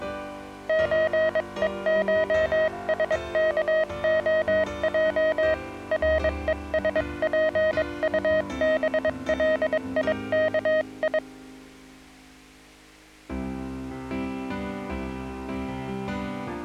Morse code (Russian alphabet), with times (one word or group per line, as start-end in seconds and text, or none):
0.7-5.5 ЧЕШСКОЙ
5.9-11.2 РЕСПУБЛИКИ